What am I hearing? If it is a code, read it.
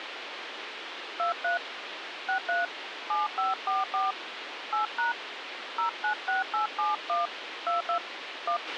DTMF, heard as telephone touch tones, dialled by hand, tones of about 130 ms, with radio hiss and a squelch burst at the end. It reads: 23 63 7544 8# 096871 22 1